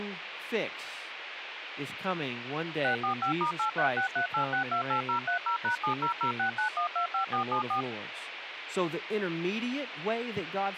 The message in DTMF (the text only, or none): 645*83638628030#70069125474